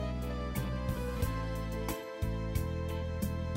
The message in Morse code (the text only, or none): none